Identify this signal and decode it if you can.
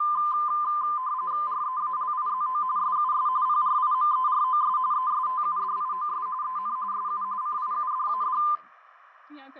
RTTY (45.45 baud, 170 Hz shift), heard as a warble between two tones, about 1110 Hz centre, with radio static and speech in English. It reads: REALIZO SUS PRIMEROS ESTUDIOS EN SU CIUDAD